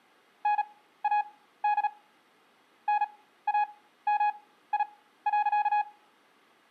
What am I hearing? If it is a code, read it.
Morse code, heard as a keyed tone, machine-sent, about 37 wpm, spaced as for 16 wpm, 830 Hz, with room echo. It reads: NAD NAMI.